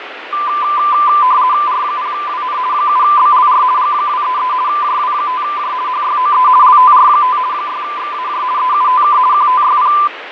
RTTY (50 baud, 170 Hz shift), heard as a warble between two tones, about 1100 Hz centre, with radio static and fading. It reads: R0WN 7BLR G233 JW5J HYOE LTR5 6XAJ EUTK QTYP